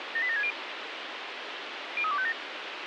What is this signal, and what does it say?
Five-tone selective call (ZVEI), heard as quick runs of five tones, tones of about 70 ms, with radio hiss and a squelch burst at the end. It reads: 78760 03257